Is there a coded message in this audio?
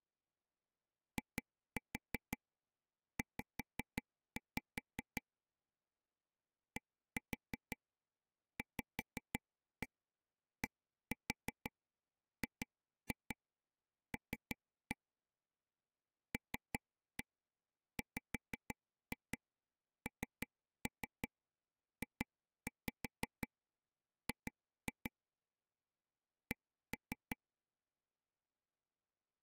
Yes: tap code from 1.2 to 27.4 s, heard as taps on a table, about 5 knocks a second. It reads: IZ DVDGL LWNJG C